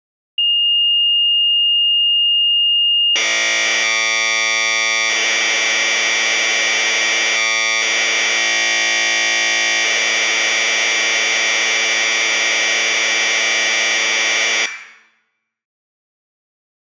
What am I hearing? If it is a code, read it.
Commodore tape loading (standard loader), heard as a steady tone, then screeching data, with room echo.